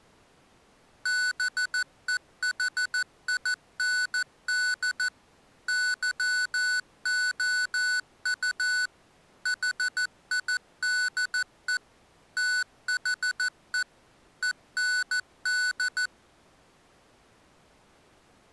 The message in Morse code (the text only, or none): BEHIND YOU HIDE THE END